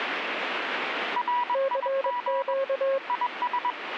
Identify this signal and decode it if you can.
Morse code, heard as two keyed tones, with radio static. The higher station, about 21 wpm, 980 Hz: RIG IS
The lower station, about 23 wpm, 540 Hz: CQ